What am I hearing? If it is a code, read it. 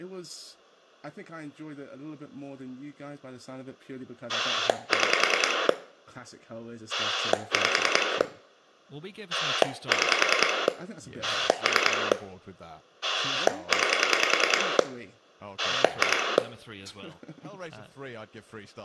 Pulse dialling, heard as a rotary dial, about 10 pulses a second, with room echo and speech in English. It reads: 6 5 6 3 9 2